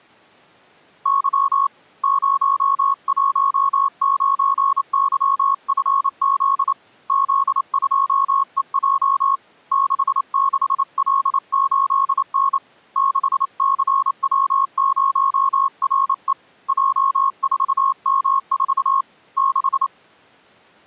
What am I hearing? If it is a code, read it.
Morse code, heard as a keyed tone, hand-sent with a paddle, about 28 wpm, 1090 Hz. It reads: Y 019YFZ Z2EJ 66L8N 6CW0RE J4M4 6